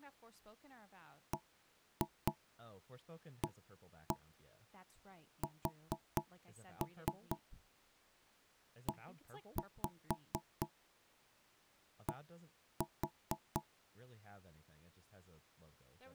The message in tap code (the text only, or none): BASED